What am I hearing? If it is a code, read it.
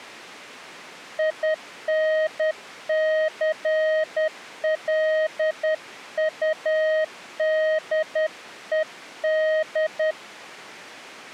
Morse code, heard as a keyed tone, hand-sent with a paddle, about 10 wpm, 630 Hz. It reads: INCLUDED